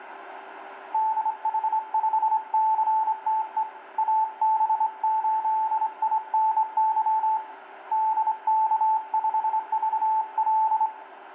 Morse code, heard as a keyed tone, hand-sent with a straight key, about 26 wpm, 880 Hz, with radio static, a steady whistle near 390 Hz and room echo. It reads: DH5CTE AB8INY DK5VL